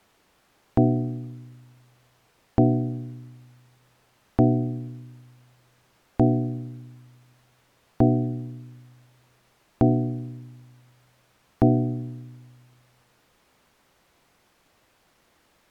Clock strike, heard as a bell. 7. Seven o'clock.